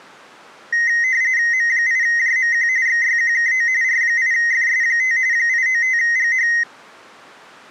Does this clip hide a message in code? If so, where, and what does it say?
Yes: RTTY (45.45 baud, 170 Hz shift) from 0.7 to 6.6 s, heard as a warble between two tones, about 1950 Hz centre. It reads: M8JMQ XYQKO R8FS5 895GH